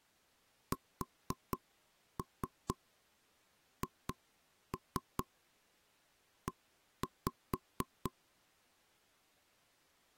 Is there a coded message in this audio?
Yes: tap code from 0.7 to 8.1 s, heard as knocks on wood, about 4 knocks a second. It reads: SHE